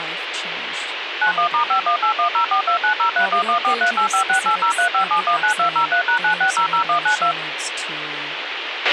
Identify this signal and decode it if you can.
DTMF, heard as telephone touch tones, dialled by machine, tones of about 100 ms, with radio hiss, a squelch burst at the end and speech in English. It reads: 91*518104290311438568035719203#9600192